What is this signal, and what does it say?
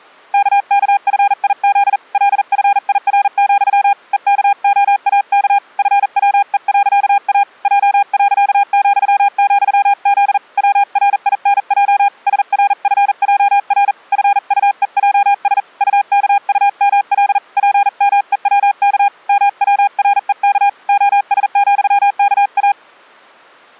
Morse code, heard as a keyed tone, hand-sent with a paddle, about 40 wpm, 810 Hz. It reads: KKFIZ LFIR, EKOAK FWE.A J.,,Z WRINJ SRFJR FUEJS UKUML PMEWK MWREK OS,KA